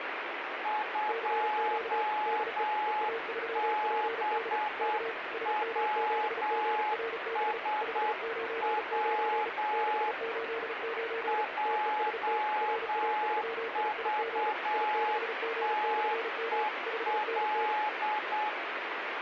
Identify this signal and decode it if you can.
Morse code, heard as two keyed tones, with radio static. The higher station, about 8 wpm, 850 Hz: 2BWSW JVTEL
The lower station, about 35 wpm, 460 Hz: CQ DE EA3PD K SM7GRB 599 689 TEST RA3IIG I6G/M 5NN